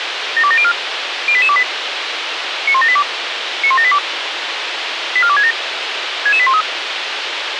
Five-tone selective call (ZVEI), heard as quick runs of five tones, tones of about 70 ms, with radio hiss. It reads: 72704 08828 91782 91782 84267 66813